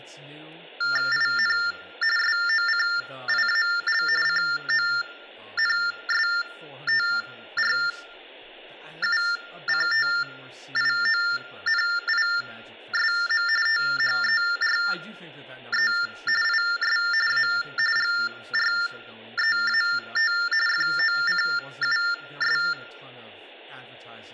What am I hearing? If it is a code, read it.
TTY/TDD text telephone tones (45.45 baud Baudot), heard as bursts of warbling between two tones, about 400 Hz shift, 1600 Hz centre, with room echo and speech in English. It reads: IN SOCIAL CONSTRUCTIONISM THERE IS A GREAT FOCUS